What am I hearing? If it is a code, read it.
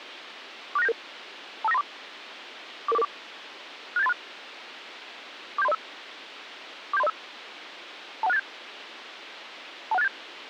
Five-tone selective call (EIA), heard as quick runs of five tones, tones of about 30 ms, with radio hiss. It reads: 46977 25934 44444 67836 47305 47305 21687 21687